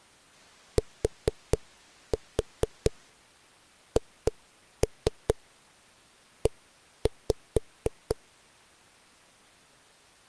Tap code, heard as knocks on a wall, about 4 knocks a second. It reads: THE